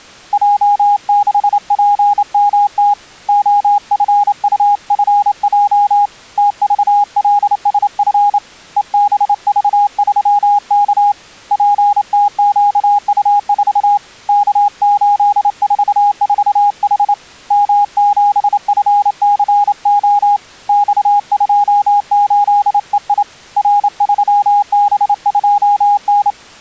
Morse code, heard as a keyed tone, hand-sent with a straight key, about 28 wpm, 820 Hz. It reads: J6PMT OFUFJ TVLSF EBV3K PTQU4 K844H M7FCO X28EI R3B2N